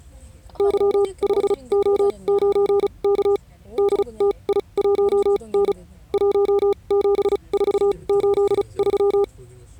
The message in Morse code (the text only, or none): Y5O9K DTI1N 17483